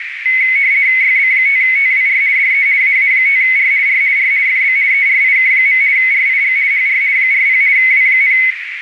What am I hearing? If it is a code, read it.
RTTY (50 baud, 170 Hz shift), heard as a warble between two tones, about 2150 Hz centre, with radio static and a narrow filter. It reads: YB5TWR DE AA5R R R FB ERIK. RIG HR 40 W,